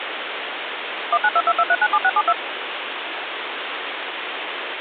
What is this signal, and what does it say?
DTMF, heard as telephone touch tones, dialled by machine, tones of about 50 ms, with phone line noise. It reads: 19222397672